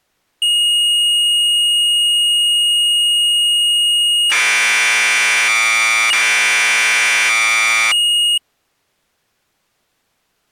Commodore tape loading (standard loader), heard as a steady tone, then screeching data.